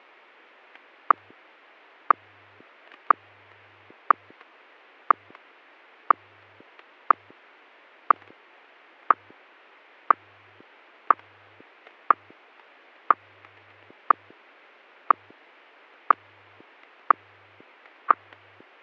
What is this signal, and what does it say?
Radio time signal (WWVH, Hawaii), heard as ticks, one a second, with static crashes.